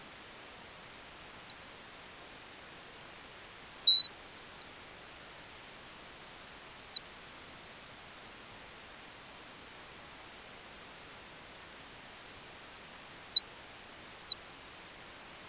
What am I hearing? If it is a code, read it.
Bird-like chirps. There is no code.